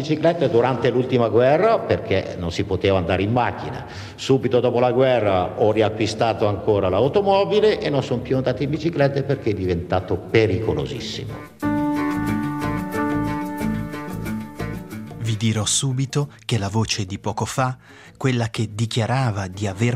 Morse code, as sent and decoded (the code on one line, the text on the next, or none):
none